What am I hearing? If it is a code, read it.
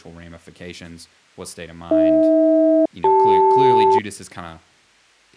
Aircraft SELCAL, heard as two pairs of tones, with speech in English. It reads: AH-CL